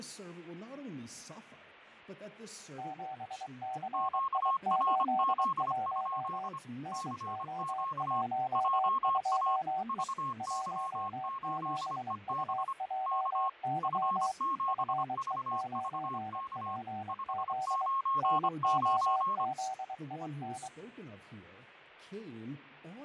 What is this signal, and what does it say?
Morse code, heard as two keyed tones, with radio static and fading. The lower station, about 23 wpm, 760 Hz: 7CI81 NO12E 17UJY FE9PZ NOZIN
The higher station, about 25 wpm, 1080 Hz: QRZ? CQ JA VY8EB K F7VVK 599